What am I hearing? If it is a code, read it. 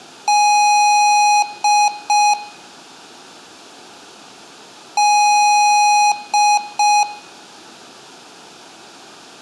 Beep code, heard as beeps from a small speaker, played twice, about 830 Hz, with room echo. 1 long, 2 short. In Award, IBM and AMI BIOS tables: video adapter failure.